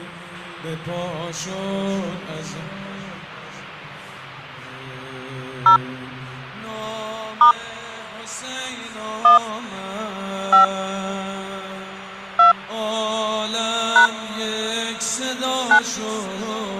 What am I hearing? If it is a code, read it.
DTMF, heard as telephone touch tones, dialled by hand, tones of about 120 ms. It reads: 0 * 1 5 2 # 9